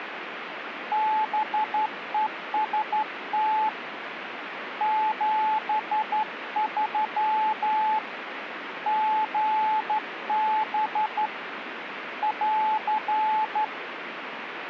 Morse code, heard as a keyed tone, hand-sent with a straight key, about 12 wpm, 860 Hz, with radio static. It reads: BEST 73 GB <AR>